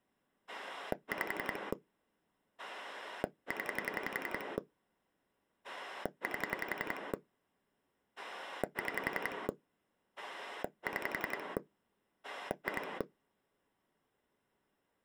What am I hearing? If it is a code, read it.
Pulse dialling, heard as a rotary dial, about 11 pulses a second. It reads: 5 0 8 6 6 2